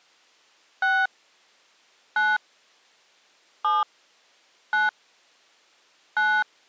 DTMF, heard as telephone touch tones, dialled by hand, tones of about 210 ms. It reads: 6 9 7 9 9